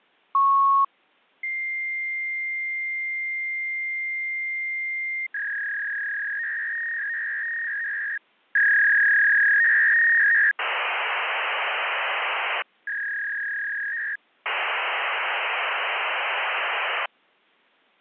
Fax machine handshake, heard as a beep, a long tone, a warble and hiss.